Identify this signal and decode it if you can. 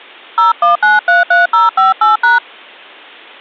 DTMF, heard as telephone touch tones, dialled by hand, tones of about 150 ms. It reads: 01933058#